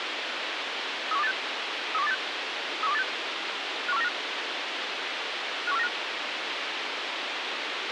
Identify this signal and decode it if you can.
Five-tone selective call (EEA), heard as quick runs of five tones, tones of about 40 ms, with radio hiss and a squelch burst at the end. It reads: 31286 31286 31286 51495 51495